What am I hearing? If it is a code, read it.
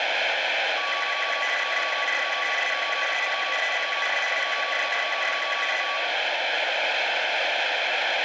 RTTY (75 baud, 850 Hz shift), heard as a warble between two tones, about 1550 Hz centre, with radio static. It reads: WIDZIALEM TO W AFRYCE